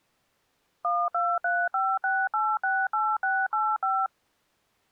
DTMF, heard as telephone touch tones, dialled by machine, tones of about 240 ms. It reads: 12356868685